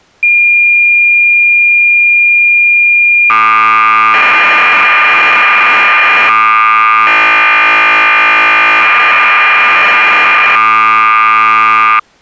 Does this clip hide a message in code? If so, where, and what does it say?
Yes: cassette data (Kansas City type), 1200 baud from 0.2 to 12.0 s, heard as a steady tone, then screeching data.